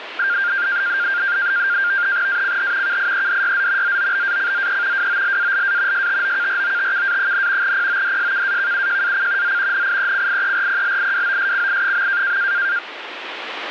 NAVTEX (SITOR-B), 100 baud, 170 Hz shift, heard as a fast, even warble, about 1500 Hz centre, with radio static. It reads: ACH KIEDYZ ZOBACZE WOLALA STOKROTKA, PODSKAKUJAC Z NIECIERPLIWOSCI.